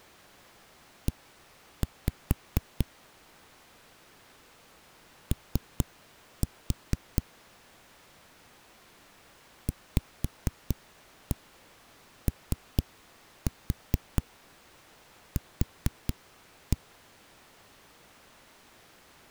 Tap code, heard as knocks on a wall, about 4 knocks a second. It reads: E O VOQ